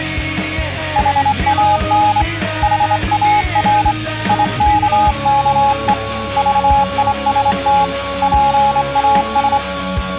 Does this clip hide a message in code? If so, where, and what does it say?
Yes: Morse code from 0.9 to 9.6 s, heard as a keyed tone, hand-sent with a straight key, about 25 wpm, 840 Hz. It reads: HAN HAR IKKE VIST PAS